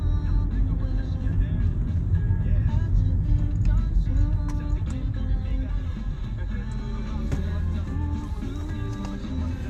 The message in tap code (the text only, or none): none